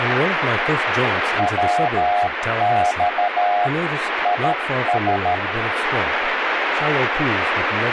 Morse code, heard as a keyed tone, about 13 wpm, 720 Hz, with radio static and speech in English. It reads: WX IS